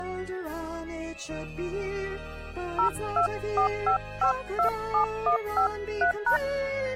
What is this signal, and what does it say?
DTMF, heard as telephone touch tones, dialled by hand, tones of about 100 ms. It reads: 0245527153#